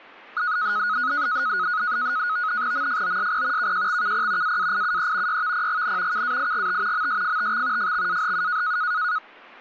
NAVTEX (SITOR-B), 100 baud, 170 Hz shift, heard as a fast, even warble, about 1360 Hz centre, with speech in Assamese. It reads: MFOSP KJXKP AAIUE YVPGN KAIGT MSFTX FXAHU